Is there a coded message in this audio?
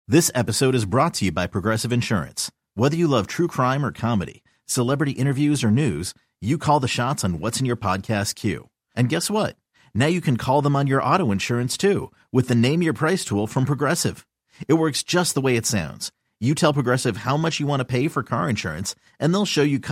No, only speech in English.